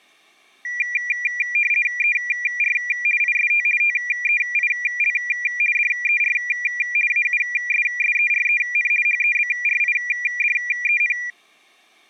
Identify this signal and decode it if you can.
RTTY (50 baud, 450 Hz shift), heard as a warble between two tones, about 2150 Hz centre. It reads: ER IST TEIL DER AUSSEREN HEBRIDEN